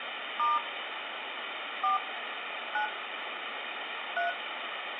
DTMF, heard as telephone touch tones, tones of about 160 ms, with phone line noise and room echo. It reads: * 4 9 3